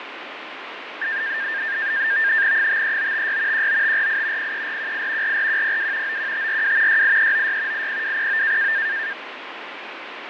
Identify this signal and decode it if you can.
NAVTEX (SITOR-B), 100 baud, 170 Hz shift, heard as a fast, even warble, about 1700 Hz centre, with radio static and fading. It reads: 53956 19548 03418 44102 91542 68396 80209